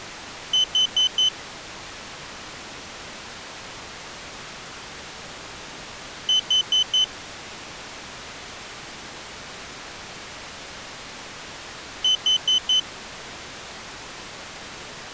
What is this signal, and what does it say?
Alarm pattern, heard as an alarm's beeps, played three times, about 3050 Hz. Temporal four. Carbon monoxide.